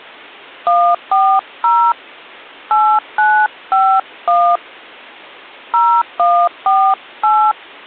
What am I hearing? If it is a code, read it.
DTMF, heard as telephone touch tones, dialled by hand, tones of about 280 ms. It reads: 140 8951 0148